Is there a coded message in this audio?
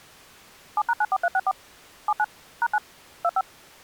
Yes: DTMF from 0.8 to 3.4 s, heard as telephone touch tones, dialled by machine, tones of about 50 ms. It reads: 7#94364 79 #9 25